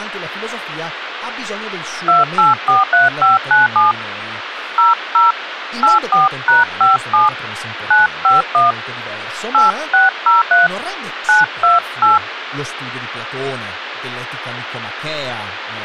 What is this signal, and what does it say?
DTMF, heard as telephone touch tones, dialled by hand, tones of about 160 ms, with phone line noise and speech in Italian. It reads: 2843597 00 84#57 951 8603 928